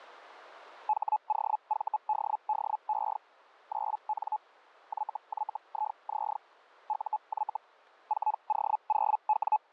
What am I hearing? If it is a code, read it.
Hellschreiber (Feld-Hell, 122.5 baud), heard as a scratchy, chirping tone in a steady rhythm, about 860 Hz. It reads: HOVDDE 9N YYIZ UY 4O0W